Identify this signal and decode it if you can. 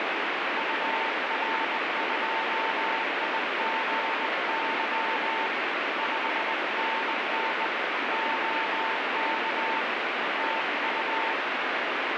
Morse code, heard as a keyed tone, hand-sent with a bug key, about 20 wpm, 900 Hz, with heavy radio static. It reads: UR2IGY 5NN OK TU